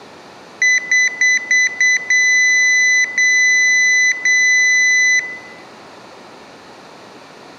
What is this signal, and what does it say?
Beep code, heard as a piezo beeper, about 2000 Hz, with room echo. 5 short, 3 long.